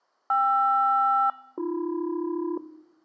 Aircraft SELCAL, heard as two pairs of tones. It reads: KR-AB